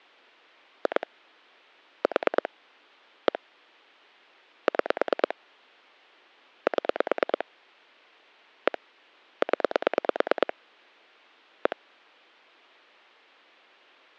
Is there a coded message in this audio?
Yes: pulse dialling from 0.9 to 11.7 s, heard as clicks on a phone line, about 9 pulses a second. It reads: 2 4 1 6 7 1 0 1